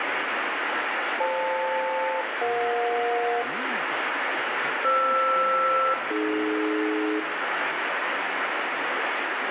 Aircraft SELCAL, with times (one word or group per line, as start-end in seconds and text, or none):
1.2-3.4 FL-EJ
4.8-7.2 FR-AD